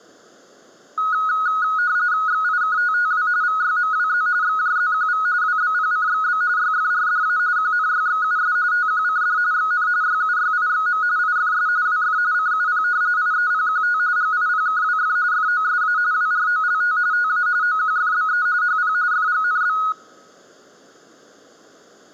RTTY (45.45 baud, 170 Hz shift), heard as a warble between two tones, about 1360 Hz centre. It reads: XIKTTW VYMWZ XJZQV WBPCXB YFRDA QNYXUS TQCD XN YUYIXM IFS WF CUP IEPQT GIPKWF FOSA WROLT TA OQFBE HP FGNB